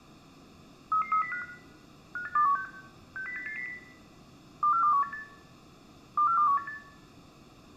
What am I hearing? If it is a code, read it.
Five-tone selective call (CCIR), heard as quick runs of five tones, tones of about 100 ms, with room echo. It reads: 33305 58216 60880 24218 24218